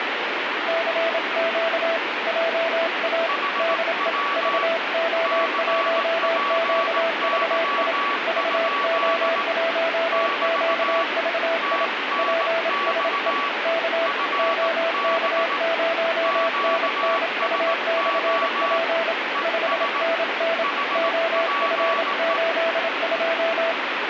Morse code, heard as two keyed tones, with heavy radio static. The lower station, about 27 wpm, 660 Hz: CQ JA DE VO1QVI VO1QVI PSE K OK0NNU/P 5NN OF82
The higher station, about 18 wpm, 1140 Hz: HW CPY? <BT> TNX FB QSO ES HPE